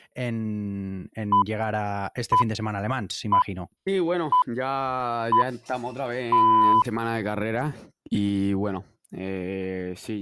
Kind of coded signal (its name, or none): radio time signal